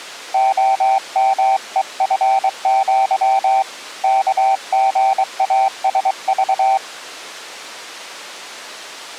Morse code (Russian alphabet), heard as a keyed tone, hand-sent with a paddle, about 23 wpm, 780 Hz. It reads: ОМЕФЪ КГАСЖ